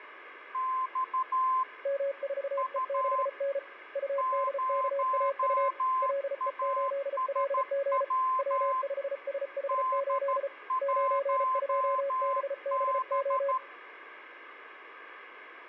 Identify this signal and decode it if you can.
Morse code, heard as two keyed tones, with radio static. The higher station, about 13 wpm, 1040 Hz: X U 0ASW D1B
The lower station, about 34 wpm, 560 Hz: M4E6N UDKAU LE8LG W5SH8 92BBO